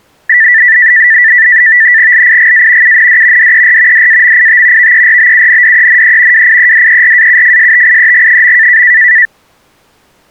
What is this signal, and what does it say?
NAVTEX (SITOR-B), 100 baud, 170 Hz shift, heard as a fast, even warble, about 1850 Hz centre. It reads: LIGA UND DER DAMIT VERBUNDENE WIEDERAUFSTIEG.